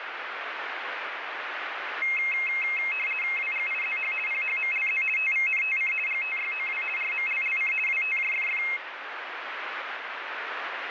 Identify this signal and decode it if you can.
RTTY (50 baud, 450 Hz shift), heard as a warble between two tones, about 2350 Hz centre, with radio static. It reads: WGIZH PHMLZ TVNTC GTYOW RMLLC WTJFF